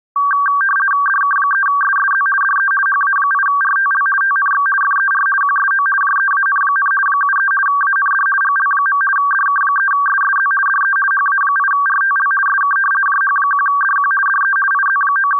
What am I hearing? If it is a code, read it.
RTTY (50 baud, 450 Hz shift), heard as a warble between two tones, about 1360 Hz centre. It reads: DK3SSZ DE HA8RTL TNX FER QSO JEAN, 73 AND GL. DK3SSZ DE HA8RTL SK JH1DQ DE …